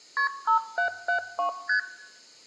Multi-frequency trunk signalling (R1, as on North American trunks), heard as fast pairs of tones, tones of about 100 ms, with room echo. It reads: KP 5772 ST